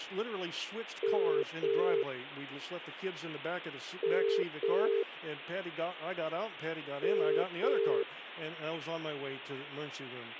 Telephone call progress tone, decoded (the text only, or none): ringback tone